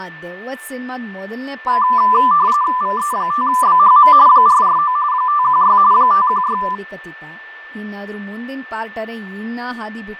RTTY (45.45 baud, 170 Hz shift), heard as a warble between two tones, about 1090 Hz centre, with fading, a steady whistle near 1770 Hz and speech in Kannada. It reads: VE5BHM 449 516 516